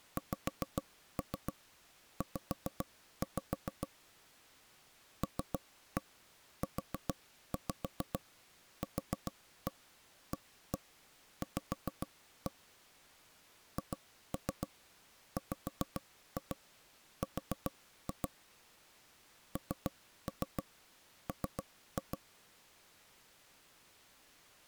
Tap code, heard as taps on a table, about 7 knocks a second. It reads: XZ LUQAV HWR NM